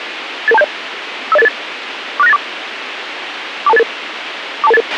Five-tone selective call (EIA), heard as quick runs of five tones, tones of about 30 ms, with radio hiss and a squelch burst at the end. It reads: 88270 50888 46984 42288 42288